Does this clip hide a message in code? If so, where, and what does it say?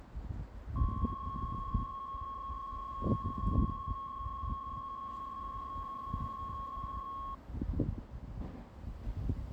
Yes: PSK63 (62.5 baud) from 0.8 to 7.3 s, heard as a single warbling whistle, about 1090 Hz, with the noise of a residential street.